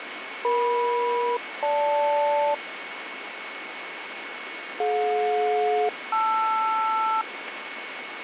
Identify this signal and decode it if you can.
Aircraft SELCAL, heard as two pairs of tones, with radio static and a steady whistle near 2210 Hz. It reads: EM-GL DJ-LR